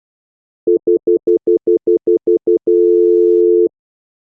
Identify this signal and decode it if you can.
Telephone call progress tone (North American plan), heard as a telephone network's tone, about 350, 440 Hz, 0.1 s on and 0.1 s off. Stutter dial tone.